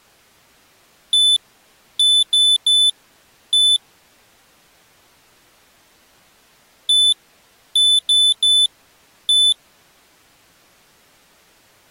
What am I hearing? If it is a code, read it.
Beep code, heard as a piezo beeper, played twice, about 3500 Hz. 1-3-1. In Phoenix BIOS tables: memory refresh failure.